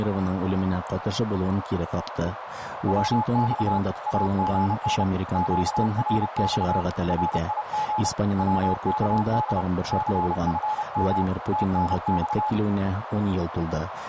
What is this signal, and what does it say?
Morse code, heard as a keyed tone, hand-sent with a paddle, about 30 wpm, 850 Hz, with radio static and a narrow filter. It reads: WX AGN QRX RIG WKD CFM TNX